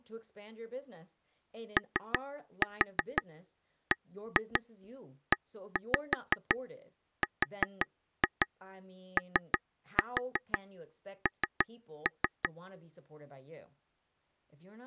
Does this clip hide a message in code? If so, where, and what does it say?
Yes: tap code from 1.8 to 12.5 s, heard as taps on a table, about 5 knocks a second, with speech in English. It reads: OBERON